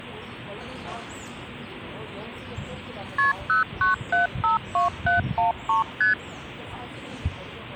Multi-frequency trunk signalling (R1, as on North American trunks), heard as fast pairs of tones, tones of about 140 ms, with the noise of a park. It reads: KP 09752713 ST